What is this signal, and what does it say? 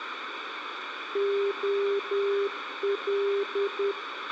Morse code, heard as a keyed tone, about 10 wpm, 400 Hz, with radio hiss, a squelch burst at the end and room echo. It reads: OL